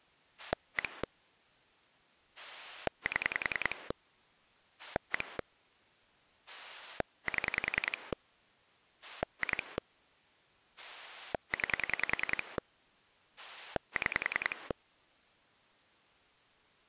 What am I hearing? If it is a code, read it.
Pulse dialling, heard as a rotary dial, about 10 pulses a second. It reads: 1 7 1 7 2 9 6